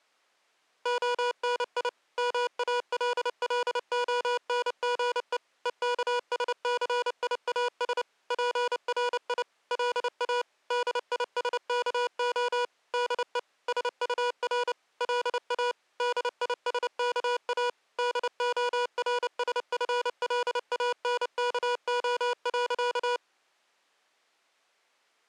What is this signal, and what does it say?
Morse code, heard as electronic beeps, machine-sent, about 29 wpm, 490 Hz. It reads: ONI MALLONGE EKSCIAS PRI LA DISKO DE SUR LA DISKA DORSFLANKO.